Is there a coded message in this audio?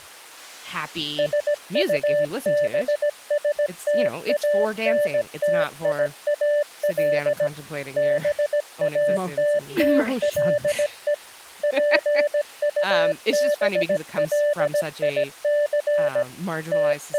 Yes: Morse code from 1.1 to 17.2 s, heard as a keyed tone, machine-sent, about 17 wpm, 590 Hz, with speech in English. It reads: SUBSTANTIAL BATTLE PUBLIC …